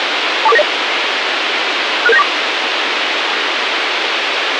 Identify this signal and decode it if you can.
Five-tone selective call (EIA), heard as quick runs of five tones, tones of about 30 ms, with radio hiss and a squelch burst at the end. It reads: 24490 66794